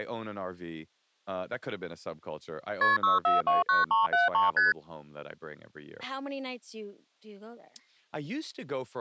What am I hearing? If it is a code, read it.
Multi-frequency trunk signalling (R1, as on North American trunks), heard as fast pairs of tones, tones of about 160 ms, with speech in English. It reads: KP 6429373 ST